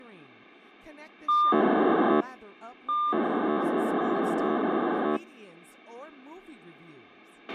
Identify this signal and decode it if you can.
POCSAG pager data (2400 baud), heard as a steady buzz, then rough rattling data, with a squelch burst at the end and speech in English.